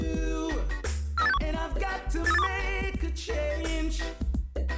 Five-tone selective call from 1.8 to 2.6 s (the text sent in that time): 83821